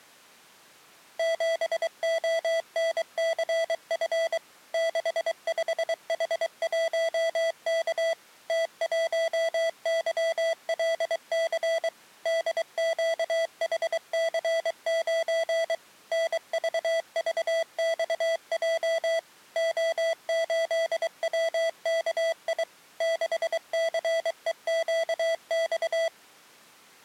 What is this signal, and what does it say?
Morse code, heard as electronic beeps, machine-sent, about 23 wpm, 660 Hz. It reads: 7ONCF 65H1K T1YLC DQHC9 NVVXJ O8WKI 6CEQX